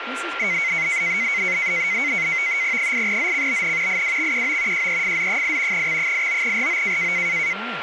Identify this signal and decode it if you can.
NAVTEX (SITOR-B), 100 baud, 170 Hz shift, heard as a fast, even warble, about 2150 Hz centre, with radio static, a steady whistle near 1380 Hz and speech in English. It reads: 8ZCBN IWXQO JEFZ8 X89RO